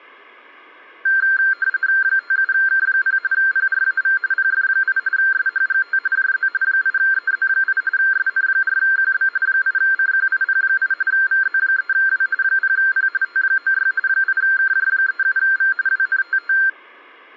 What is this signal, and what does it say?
RTTY (45.45 baud, 170 Hz shift), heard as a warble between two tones, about 1480 Hz centre. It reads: 57K0 PRAV PF8 SHGT JZ 8EZ8 SN4QB 8CQIP8 VZ3W 0P T96 8KJ37V WNTT